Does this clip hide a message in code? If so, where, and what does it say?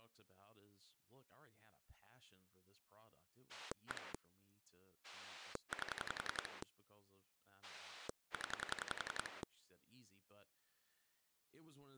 Yes: pulse dialling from 3.5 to 9.4 s, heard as a rotary dial, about 11 pulses a second, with speech in English. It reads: 1 8 0